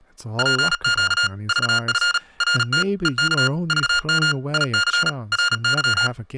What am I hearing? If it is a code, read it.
Morse code, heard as electronic beeps, machine-sent, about 37 wpm, 1420 Hz, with speech in English. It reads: PQ VF RT EK VM IC RY